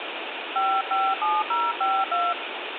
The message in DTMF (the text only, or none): 557052